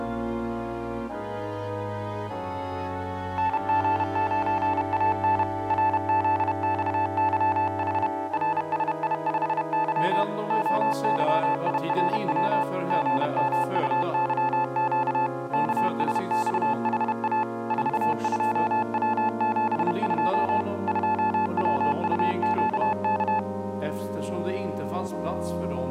Morse code, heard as a keyed tone, machine-sent, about 31 wpm, 870 Hz. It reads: NG9AN RZXYH RSI5Y OYIRW GMUYQ KSXHA 42W72 2WUQK